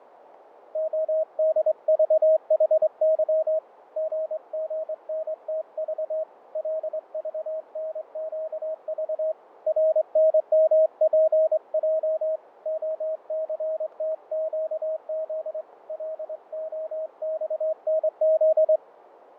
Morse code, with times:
0.8-3.6 ODVHY
4.0-6.2 GGNTV
6.6-9.3 LVNQV
9.7-12.4 RNMPJ
12.7-15.6 OCTQZ
15.9-18.8 LOXNZ

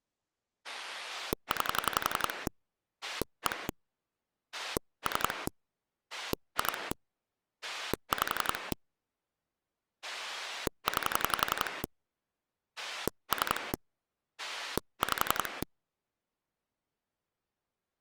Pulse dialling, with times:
0.6-2.5 9
3.0-3.7 1
4.5-5.5 3
6.1-6.9 2
7.6-8.7 5
10.0-11.8 9
12.8-13.7 3
14.4-15.6 5

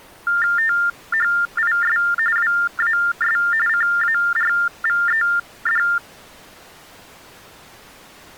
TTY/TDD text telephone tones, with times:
0.6-2.0 THIS
2.4-3.4 WAS
3.7-5.8 CARVED

